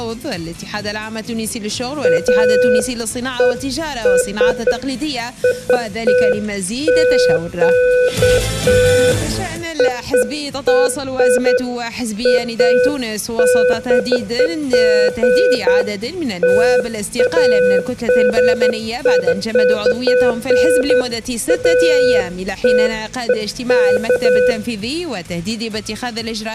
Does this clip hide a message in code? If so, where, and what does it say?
No, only beeps of irregular length, with room echo.